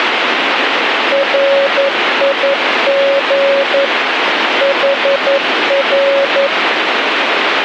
Morse code, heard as a keyed tone, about 11 wpm, 550 Hz, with radio static. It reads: RIG HR